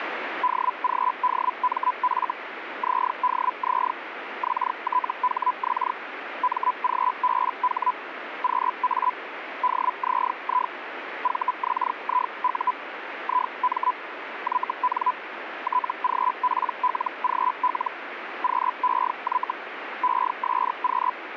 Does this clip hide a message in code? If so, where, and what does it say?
Yes: Hellschreiber (Feld-Hell, 122.5 baud) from 0.4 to 21.1 s, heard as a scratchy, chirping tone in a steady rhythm, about 1000 Hz, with radio static. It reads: DGDMF ZDZ XTHX MGBH QA DZI VXIU IM YN TGPLGL QEY ESQ